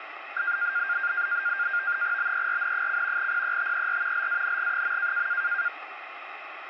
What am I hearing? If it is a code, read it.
NAVTEX (SITOR-B), 100 baud, 170 Hz shift, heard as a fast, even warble, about 1500 Hz centre, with radio static. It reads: BERN: PETER LANG.